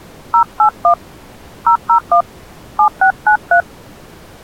DTMF, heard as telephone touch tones, dialled by hand, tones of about 90 ms. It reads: 081 001 7693